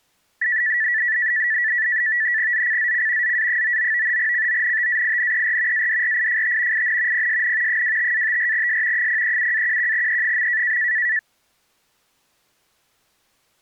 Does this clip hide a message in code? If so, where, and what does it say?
Yes: NAVTEX (SITOR-B), 100 baud, 170 Hz shift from 0.4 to 11.2 s, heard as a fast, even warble, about 1850 Hz centre. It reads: ZCZC ZA99 CONTAINER ADRIFT IN PSN 25-54S 037-11E.